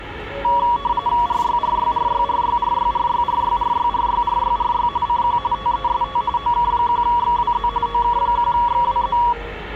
RTTY (45.45 baud, 170 Hz shift), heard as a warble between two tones, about 1040 Hz centre, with the noise of a subway station. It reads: RYRYRYRYRYRYRYRYRYRYRY CQ TEST OK1XWZ OK1XWZ